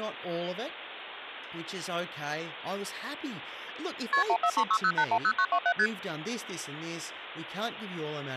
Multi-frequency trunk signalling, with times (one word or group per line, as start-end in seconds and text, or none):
4.1-4.2 KP
4.3-5.7 14360810927
5.8-5.9 ST